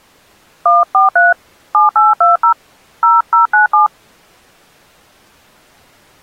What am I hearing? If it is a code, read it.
DTMF, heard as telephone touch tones, dialled by hand, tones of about 140 ms. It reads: 143 7820 0097